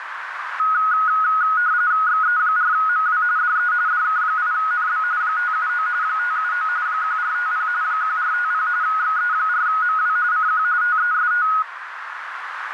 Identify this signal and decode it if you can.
RTTY (45.45 baud, 170 Hz shift), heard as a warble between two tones, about 1360 Hz centre, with radio static and a narrow filter. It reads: XE4MW DE DK8NB 579 579 1450 1450 XE4MW CQ TEST